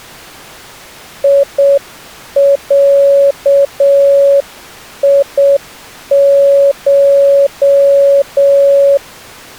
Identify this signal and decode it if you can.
Morse code (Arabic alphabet), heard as a keyed tone, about 7 wpm, 560 Hz. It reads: يعيش